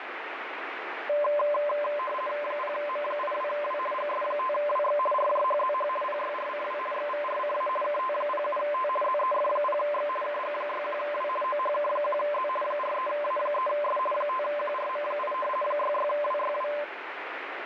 RTTY (50 baud, 450 Hz shift), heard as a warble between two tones, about 810 Hz centre, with radio static. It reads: 0M82W GS5WX RJHZH PYRCW XVRCA KT07T ZEF0X KG61W OHK1Z 43A3S 5QRM8 66WYW